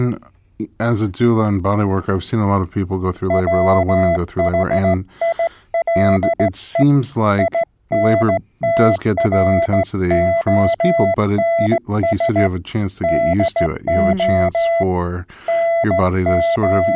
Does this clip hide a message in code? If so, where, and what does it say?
Yes: Morse code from 3.2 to 17.0 s, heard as a keyed tone, hand-sent with a straight key, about 16 wpm, 670 Hz, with speech in English. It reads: WHILE INTRONS DO …